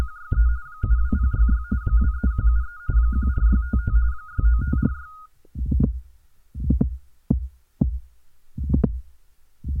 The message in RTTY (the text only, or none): … 72066 23173 14655 69546